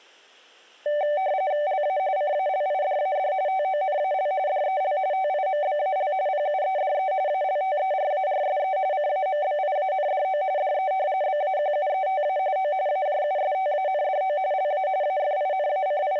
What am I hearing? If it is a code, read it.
RTTY (45.45 baud, 170 Hz shift), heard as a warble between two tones, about 680 Hz centre. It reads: LA CALIDAD TONAL DEL TIMBAL PUEDE ALTERARSE CAMBIANDO DE BAQUETA O AJUSTANDO LA …